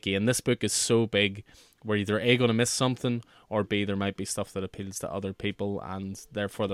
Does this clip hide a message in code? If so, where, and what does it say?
No, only speech in English.